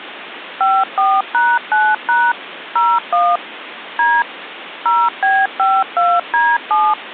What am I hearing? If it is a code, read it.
DTMF, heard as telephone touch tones, dialled by machine, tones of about 230 ms, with phone line noise. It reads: 54#9# 01 D 0B52D7